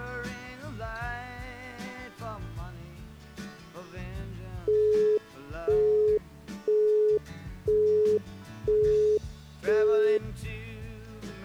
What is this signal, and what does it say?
Telephone call progress tone (single-tone plan, as in Europe, Japan and elsewhere), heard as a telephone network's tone, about 420 Hz, 0.5 s on and 0.5 s off. Busy tone.